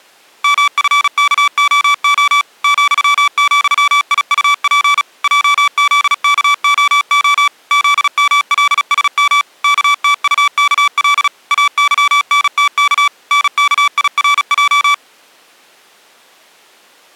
Morse code, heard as electronic beeps, machine-sent, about 36 wpm, 1150 Hz. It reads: MFKOO ,,IUP JZKOO ZMLSM KTUKL AYNTK NKIRJ